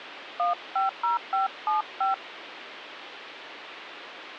DTMF, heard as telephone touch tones, dialled by hand, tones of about 140 ms, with phone line noise. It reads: 150575